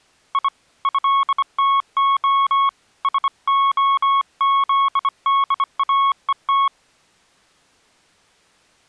Morse code (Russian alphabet), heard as a keyed tone, hand-sent with a bug key, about 25 wpm, 1100 Hz. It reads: И ЭТО СОЗДАЕТ